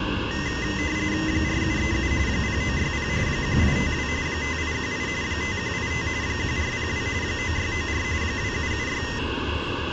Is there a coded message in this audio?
Yes: RTTY (45.45 baud, 170 Hz shift) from 0.3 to 9.2 s, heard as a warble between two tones, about 1950 Hz centre, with radio static and the noise inside a bus. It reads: 4737 0960 1852 5818 5185 1402 9694 2776